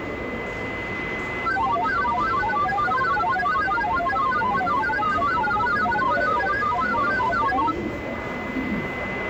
Multi-tone FSK (Olivia or MFSK type), about 1000 Hz wide, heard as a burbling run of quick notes, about 31.25 baud, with radio static, a steady whistle near 2030 Hz and the noise of a crowd indoors.